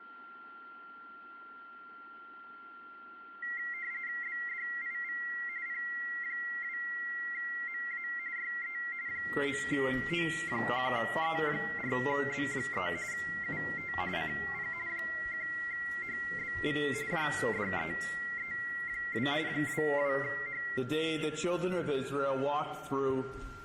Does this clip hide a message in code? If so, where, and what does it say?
Yes: RTTY (45.45 baud, 170 Hz shift) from 3.4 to 20.8 s, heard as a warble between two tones, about 2000 Hz centre, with a steady whistle near 1380 Hz. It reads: BDIV P2MA YE 9O1E4B3 UT CP 1HBV JDEE2 22H